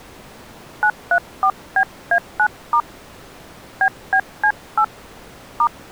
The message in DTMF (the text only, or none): 934BA9* BBC8 *